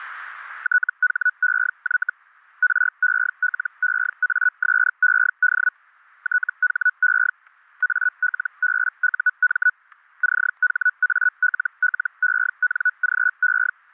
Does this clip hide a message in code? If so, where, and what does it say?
Yes: Hellschreiber (Feld-Hell, 122.5 baud) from 0.6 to 13.7 s, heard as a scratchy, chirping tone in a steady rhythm, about 1480 Hz, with static crashes. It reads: THEY RELEASED THE ALBUM CHALLENGE